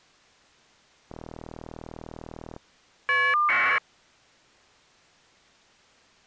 Caller ID data burst, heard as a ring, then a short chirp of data, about 1200 baud.